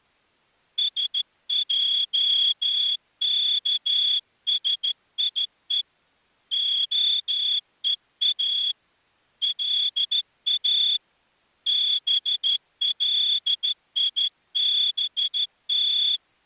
Morse code (Hebrew alphabet), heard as a whistle, hand-sent with a straight key, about 13 wpm. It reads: שעכשיו הוא לא בליבת